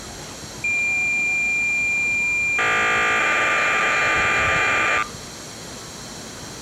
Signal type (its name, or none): cassette data (Kansas City type)